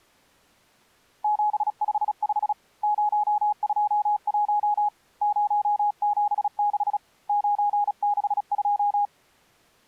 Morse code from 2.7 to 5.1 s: 021

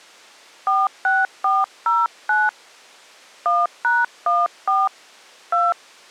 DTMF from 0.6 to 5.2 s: 46409 1#14

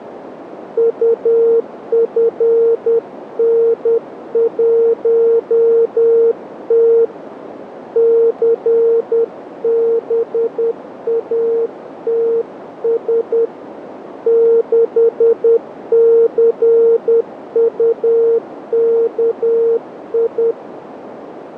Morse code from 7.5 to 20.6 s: CBATS 6CUKI

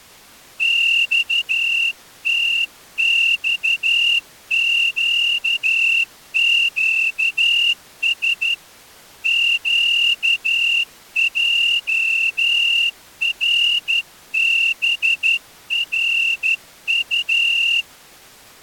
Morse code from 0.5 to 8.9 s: XTXQQS

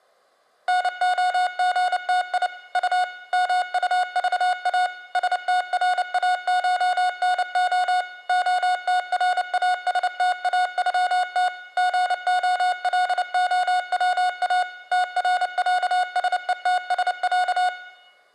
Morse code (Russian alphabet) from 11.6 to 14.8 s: ГОЛОВА

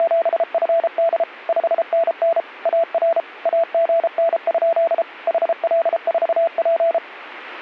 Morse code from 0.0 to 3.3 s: … 5NN AR

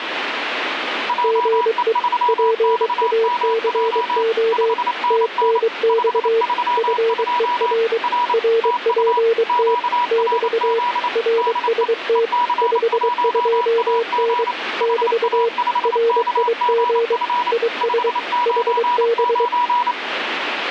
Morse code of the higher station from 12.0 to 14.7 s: EC1AG

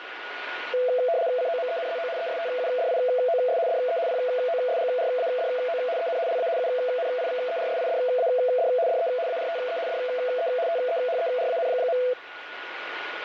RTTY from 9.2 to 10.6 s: ARTE DE

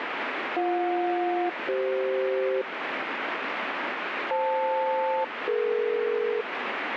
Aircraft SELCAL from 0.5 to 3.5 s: BJ-CF

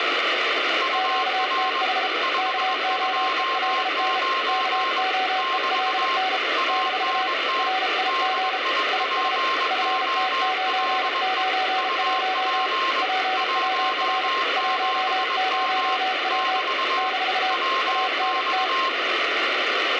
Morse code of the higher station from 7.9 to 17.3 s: DIPOLE UP 17M <BT>

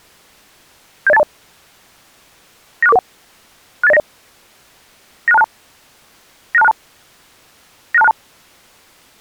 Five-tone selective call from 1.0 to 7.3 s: 70820 96441 68090 96262 96262

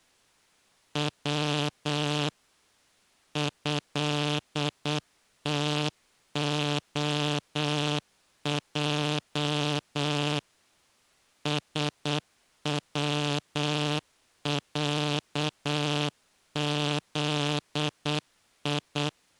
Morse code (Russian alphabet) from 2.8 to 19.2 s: ЭТОЙ СВЯЗИ

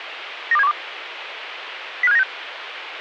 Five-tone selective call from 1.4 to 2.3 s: 05796

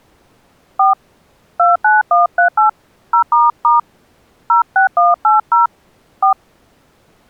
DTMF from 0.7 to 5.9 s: 4 29138 0** 06180

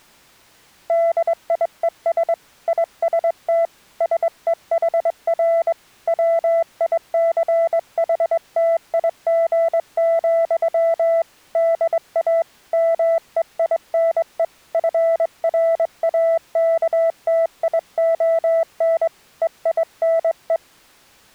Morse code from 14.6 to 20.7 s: FRAKTION EINE

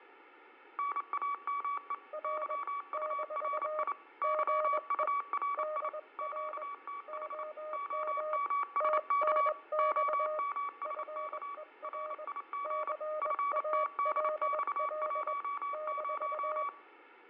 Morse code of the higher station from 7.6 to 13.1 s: OMSK OMSK RIG

